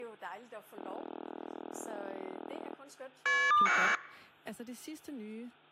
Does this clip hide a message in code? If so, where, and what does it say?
Yes: caller ID data burst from 0.8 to 4.0 s, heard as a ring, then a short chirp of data, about 1200 baud, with hum and speech in Danish.